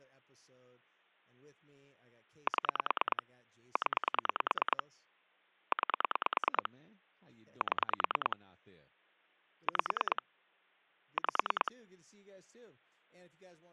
Pulse dialling, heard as clicks on a phone line, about 9 pulses a second, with speech in English. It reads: 7 0 9 7 5 5